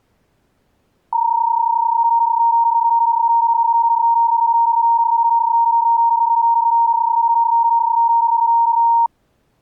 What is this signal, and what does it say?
PSK31 (31.25 baud), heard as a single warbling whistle, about 930 Hz.